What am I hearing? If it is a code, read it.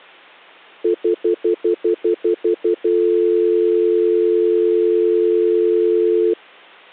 Telephone call progress tone (North American plan), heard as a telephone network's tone, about 350, 440 Hz, 0.1 s on and 0.1 s off. Stutter dial tone.